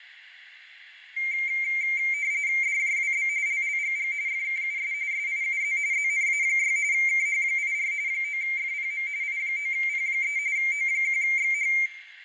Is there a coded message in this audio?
Yes: RTTY (45.45 baud, 170 Hz shift) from 1.2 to 11.9 s, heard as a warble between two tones, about 2200 Hz centre, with radio static, fading and room echo. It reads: DJWB LLGG FKUS SIUZ ZNA6 KH84 9FPM I9P3 O1XH